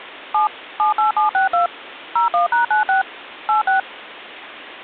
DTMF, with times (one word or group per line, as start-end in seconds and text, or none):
0.3-0.5 7
0.8-1.7 78762
2.2-3.0 01#96
3.5-3.8 86